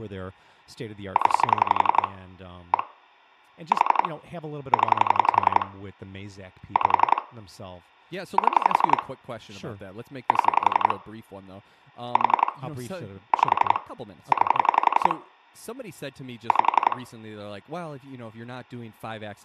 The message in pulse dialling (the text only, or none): 0 1 4 0 5 7 7 4 5 9 5